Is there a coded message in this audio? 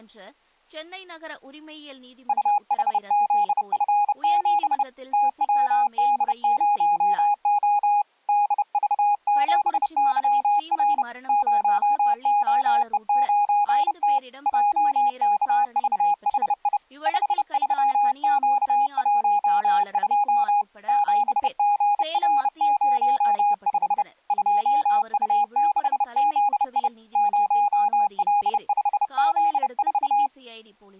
Yes: Morse code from 2.2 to 30.3 s, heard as a keyed tone, hand-sent with a bug key, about 30 wpm, 820 Hz, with speech in Tamil. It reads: UHZF7 TWD0O DV7YR 0OE9T JKVHI 53Q12 7GR05 2U6ZI 0L5Z4